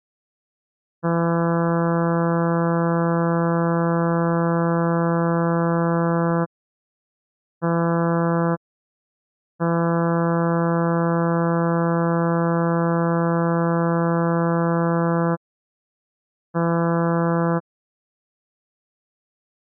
Ship horn signal, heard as a ship's horn, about 170 Hz. 1 long, 1 short, 1 long, 1 short. At sea: I agree to be overtaken.